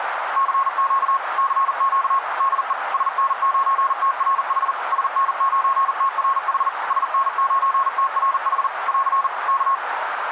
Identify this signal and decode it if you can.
Morse code, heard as a keyed tone, machine-sent, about 40 wpm, 1090 Hz, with radio static and a narrow filter. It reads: CQ CQ DE SN9TRH SN9TRH SN9TRH <AR> K